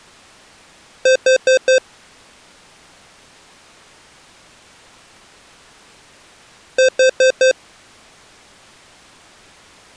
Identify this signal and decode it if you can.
Alarm pattern, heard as an alarm's beeps, played twice, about 520 Hz. Temporal four. Carbon monoxide.